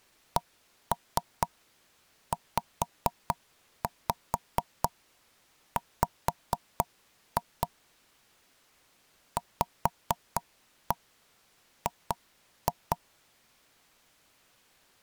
Tap code, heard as knocks on wood, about 4 knocks a second. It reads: CZW VG